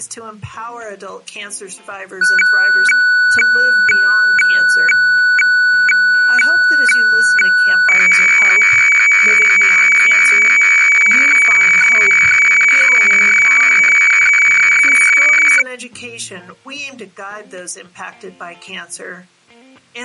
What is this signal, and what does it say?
Weather fax (radiofax), 120 lines a minute, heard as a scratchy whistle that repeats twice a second.